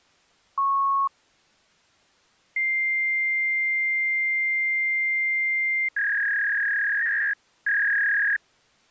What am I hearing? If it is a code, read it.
Fax machine handshake, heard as a beep, a long tone and a warble.